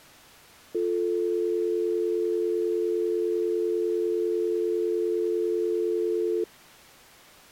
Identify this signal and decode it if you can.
Telephone call progress tone (North American or UK plan), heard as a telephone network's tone, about 350, 440 Hz. Dial tone.